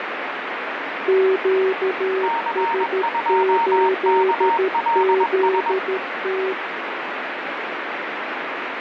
Morse code, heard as two keyed tones, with heavy radio static. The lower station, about 13 wpm, 380 Hz: QS8ZT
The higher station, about 21 wpm, 920 Hz: C2KLS